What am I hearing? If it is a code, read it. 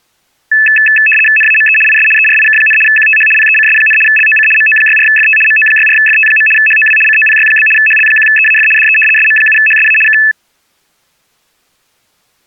RTTY (75 baud, 850 Hz shift), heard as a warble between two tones, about 2150 Hz centre. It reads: NAME IS ERIK, QTH PECS, LOC MO64FT MO64FT. HOW COPY? HL1EAF DE SM7HSA K